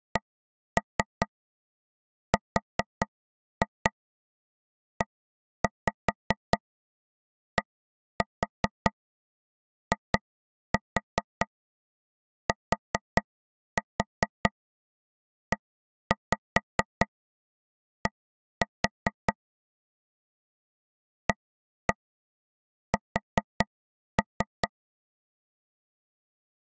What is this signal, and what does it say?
Tap code, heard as taps on a table, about 4 knocks a second. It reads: CREDITED AS